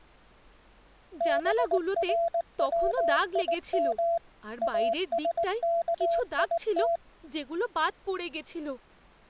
Morse code (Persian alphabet), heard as a keyed tone, machine-sent, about 19 wpm, 680 Hz, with speech in Bangla. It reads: برویم اسکیت